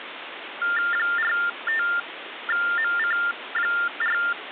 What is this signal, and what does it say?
TTY/TDD text telephone tones (45.45 baud Baudot), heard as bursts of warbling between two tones, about 400 Hz shift, 1600 Hz centre, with phone line noise. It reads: 45MC4